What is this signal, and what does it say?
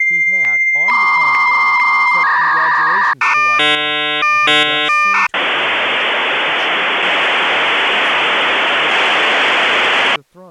Dial-up modem handshake (V.34 or later), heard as a whistle, warbles, then hiss, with speech in English.